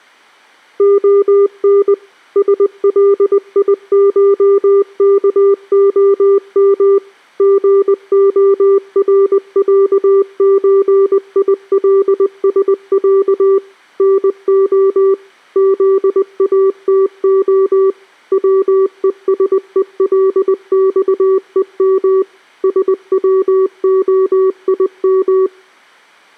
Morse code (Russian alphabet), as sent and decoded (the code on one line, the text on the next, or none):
--- -. / ... .-.. .. ---- -.- --- -- / --. --- .-. .-.- ---. .. .-.. ... .-.- / -. --- / --.. .- - --- / .-- . ... . .-.. -..- . -- / ... .-- --- .. --
ОН СЛИШКОМ ГОРЯЧИЛСЯ НО ЗАТО ВЕСЕЛЬЕМ СВОИМ